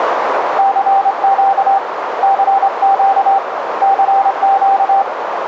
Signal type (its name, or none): Morse code